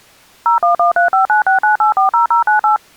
DTMF, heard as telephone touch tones, dialled by machine, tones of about 120 ms. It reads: 01135969840098